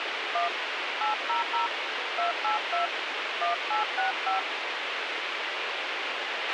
DTMF, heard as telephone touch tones, dialled by hand, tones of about 130 ms, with radio hiss and a squelch burst at the end. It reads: 1 800 282 1865